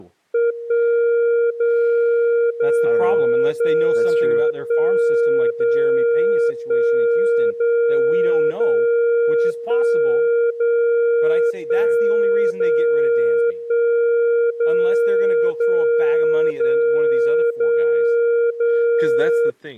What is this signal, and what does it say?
Radio time signal (DCF77), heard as a tone whose level steps once a second, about 470 Hz, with speech in English. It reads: 1 0 0 0 1 0 1 0 0 1 0 1 0 1 0 0 0 0 0